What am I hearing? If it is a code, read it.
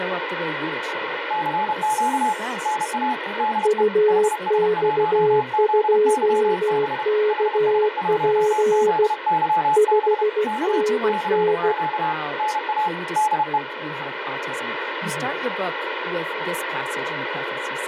Morse code, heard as two keyed tones, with radio static and speech in English. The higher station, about 31 wpm, 860 Hz: CQ NA DE HS1ZYB HS1ZYB K CQ NA DE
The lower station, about 16 wpm, 420 Hz: UX2KP 5NN